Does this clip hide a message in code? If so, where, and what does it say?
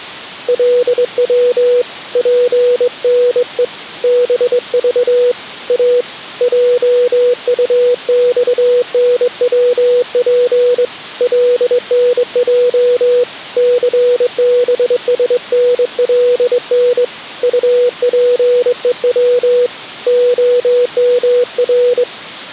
Yes: Morse code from 0.4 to 22.1 s, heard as a keyed tone, hand-sent with a straight key, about 22 wpm, 490 Hz. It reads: LW PNE BV A JUXNWP LNJ CBSNLN UPEW OMR